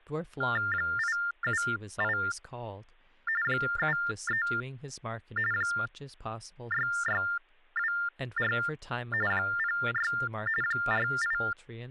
TTY/TDD text telephone tones (45.45 baud Baudot), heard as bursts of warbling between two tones, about 400 Hz shift, 1600 Hz centre, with speech in English. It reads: 878 73 6624 06 48